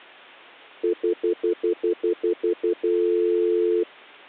Telephone call progress tone (North American plan), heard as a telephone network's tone, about 350, 440 Hz, 0.1 s on and 0.1 s off. Stutter dial tone.